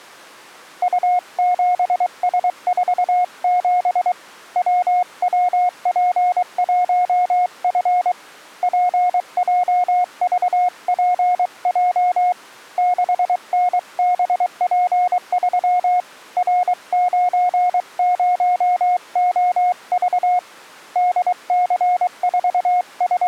Morse code, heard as a keyed tone, hand-sent with a paddle, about 23 wpm, 720 Hz. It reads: U7S47 WWP1F PJVPJ 6NBP3 R90OV …